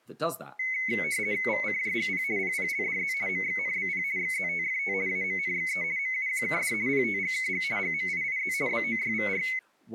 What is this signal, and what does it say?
RTTY (50 baud, 170 Hz shift), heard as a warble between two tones, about 2150 Hz centre, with speech in English. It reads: VCJGP PPLDZ MXNBP XZTFT AMNXE MUQKD PTGKG GMIIZ BOYVR